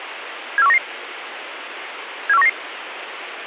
Five-tone selective call (EEA), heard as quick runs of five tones, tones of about 40 ms, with radio hiss. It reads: 74199 74199